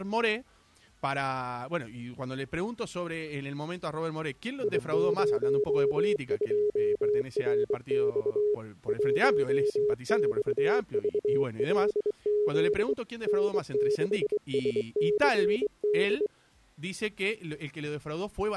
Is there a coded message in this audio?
Yes: Morse code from 4.6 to 16.3 s, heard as a keyed tone, hand-sent with a straight key, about 23 wpm, 420 Hz. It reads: I02RX 1XVLZ N6SCD